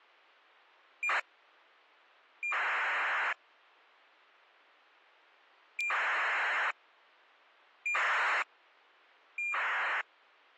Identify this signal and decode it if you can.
ACARS aircraft data, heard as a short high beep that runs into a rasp, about 2400 baud.